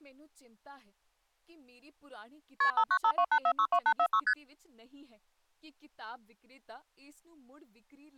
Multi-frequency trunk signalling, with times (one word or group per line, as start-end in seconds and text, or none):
2.6-2.7 KP
2.8-4.2 59528462846
4.3-4.3 ST